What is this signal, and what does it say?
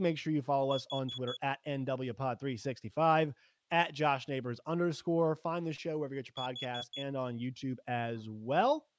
Alarm pattern, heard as an alarm's beeps, played twice, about 3400 Hz, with speech in English. Temporal four. Carbon monoxide.